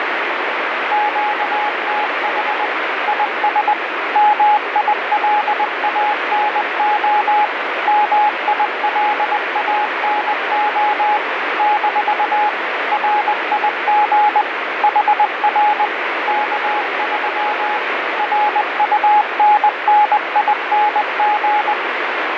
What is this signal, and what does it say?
Morse code, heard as a keyed tone, machine-sent, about 20 wpm, 840 Hz, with heavy radio static. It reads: QTH IS MILANO MILANO - RIG HR K3 RUNNING